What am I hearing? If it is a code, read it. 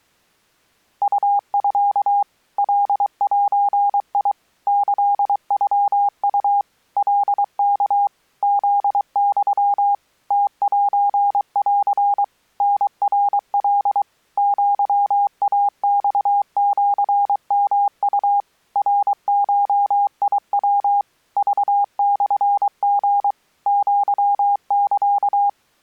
Morse code (Japanese Wabun code), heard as a keyed tone, machine-sent, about 23 wpm, 810 Hz. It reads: ウミ カゼ キノウ カワ フユ ムセン タナカ アイマシヨウ ナゴヤ クモリ アサ